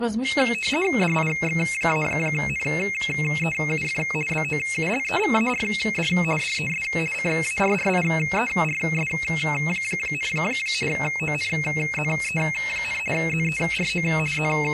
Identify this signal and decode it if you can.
RTTY (50 baud, 450 Hz shift), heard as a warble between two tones, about 2350 Hz centre. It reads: DIX-NEUF BOULEVARD DES CARRIERS, ONZE, ZERO …